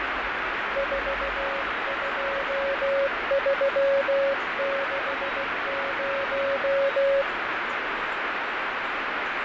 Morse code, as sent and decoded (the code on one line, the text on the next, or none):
....- ..--- ...-- -.... -----
42360